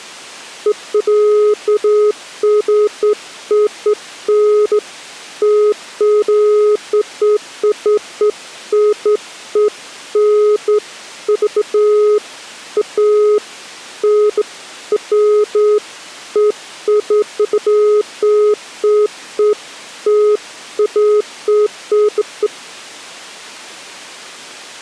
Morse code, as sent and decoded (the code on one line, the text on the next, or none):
none